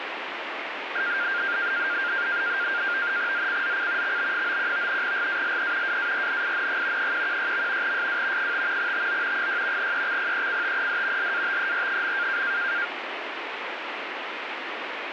NAVTEX (SITOR-B), 100 baud, 170 Hz shift, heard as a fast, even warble, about 1500 Hz centre, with radio static. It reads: ZCZC XB91 GALE WARNING 116. SW 5 TO 6 EXPECTED LATER.